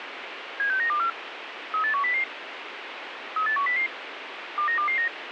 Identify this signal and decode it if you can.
Five-tone selective call (CCIR), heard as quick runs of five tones, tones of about 100 ms, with radio hiss. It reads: 76924 38100 38100 29229